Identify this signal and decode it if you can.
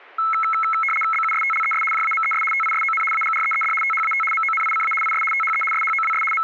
RTTY (75 baud, 850 Hz shift), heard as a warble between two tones, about 1750 Hz centre. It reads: BUSTLES JAMES TISON AGREED THAT MONICA IS THE SHOWS …